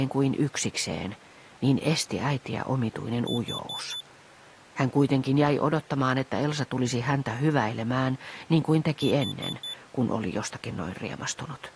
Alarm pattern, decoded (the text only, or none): temporal four